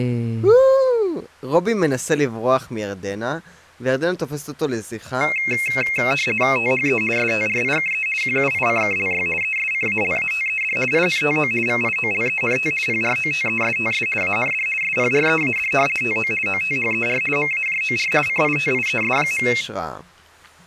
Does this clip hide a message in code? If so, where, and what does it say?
Yes: RTTY (50 baud, 450 Hz shift) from 5.2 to 19.6 s, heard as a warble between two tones, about 2350 Hz centre, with speech in Hebrew. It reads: THE STRIKE QUICKLY ESCALATED INTO VIOLENT PROTESTS AND SPREAD TO OTHER MAJOR CITIES.